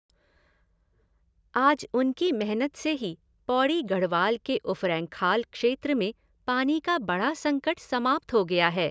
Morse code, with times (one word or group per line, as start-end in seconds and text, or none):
none